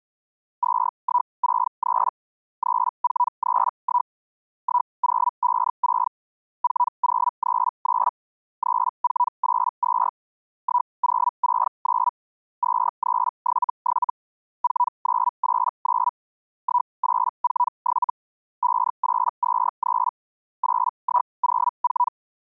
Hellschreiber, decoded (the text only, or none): 2163 3431 1056 4039 3482 1069 2377 4989 1847 5823 8104